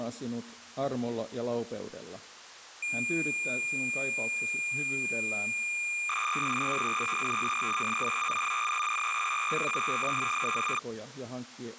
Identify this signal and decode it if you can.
Cassette data (Kansas City type), 300 baud, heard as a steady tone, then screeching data.